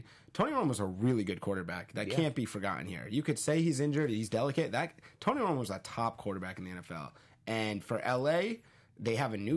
Speech in English. There is no code.